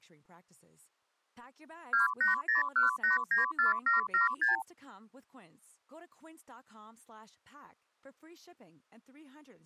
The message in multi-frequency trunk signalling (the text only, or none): 2801894776